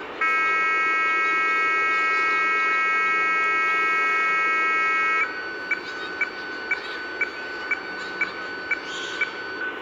Weather fax (radiofax), 120 lines a minute, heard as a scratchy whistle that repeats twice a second, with radio static, room echo and the noise of a park.